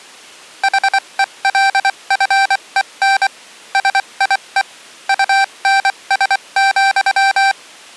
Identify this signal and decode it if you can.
Morse code, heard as electronic beeps, machine-sent, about 24 wpm, spaced as for 21 wpm, 780 Hz. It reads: HELFEN SIE UNS,